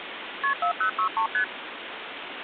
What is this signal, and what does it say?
Multi-frequency trunk signalling (R1, as on North American trunks), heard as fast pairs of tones, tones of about 100 ms, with phone line noise. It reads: KP 4063 ST